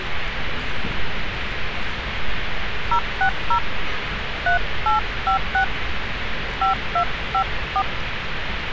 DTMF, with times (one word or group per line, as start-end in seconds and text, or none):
2.9-3.6 060
4.5-5.6 3856
6.6-7.8 5254